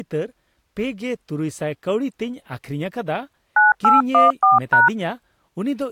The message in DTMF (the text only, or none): 9814#